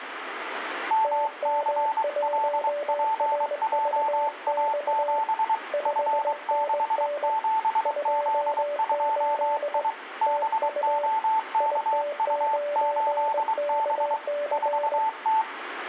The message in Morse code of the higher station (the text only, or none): MCLPJA7 F67Z2I BOKU8B 4T